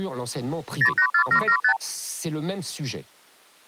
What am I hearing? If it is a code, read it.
Multi-frequency trunk signalling (R2, with the far end's replies), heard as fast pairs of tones, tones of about 80 ms, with speech in French. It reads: 084775